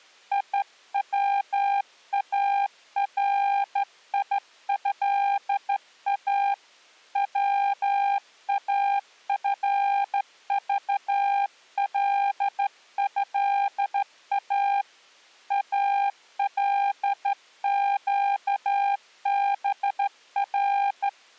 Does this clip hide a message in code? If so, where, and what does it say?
Yes: Morse code (Arabic alphabet) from 0.3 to 21.2 s, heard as a keyed tone, hand-sent with a straight key, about 13 wpm, 800 Hz. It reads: يواريها وافضلها القبر